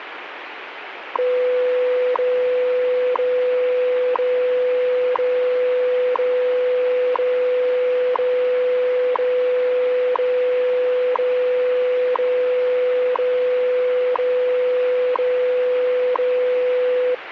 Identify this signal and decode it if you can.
Radio time signal (WWV, Colorado), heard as ticks, one a second, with radio static.